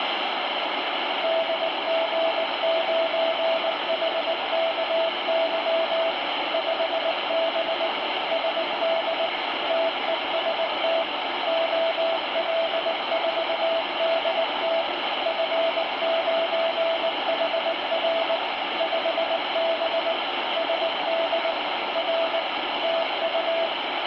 Morse code, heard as a keyed tone, machine-sent, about 19 wpm, 660 Hz, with heavy radio static. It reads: DG9HKY 5B SD TEST OL4DT F9HR 5B SD R TU